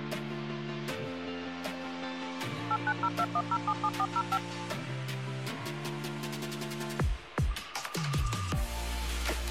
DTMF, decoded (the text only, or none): 89021077405